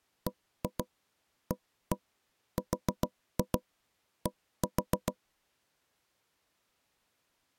Tap code, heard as knocks on wood, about 6 knocks a second. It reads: BARD